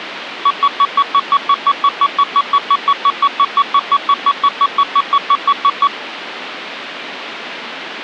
Evenly repeated beeps, with phone line noise. There is no code.